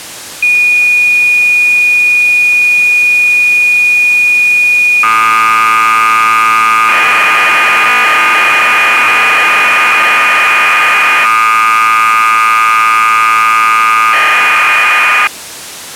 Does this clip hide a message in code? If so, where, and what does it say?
Yes: cassette data (Kansas City type), 1200 baud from 0.4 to 15.3 s, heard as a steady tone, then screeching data.